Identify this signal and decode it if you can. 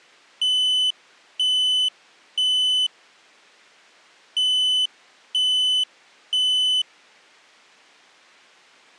Alarm pattern, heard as an alarm's beeps, played twice, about 3000 Hz. Temporal three. Smoke or fire, evacuate.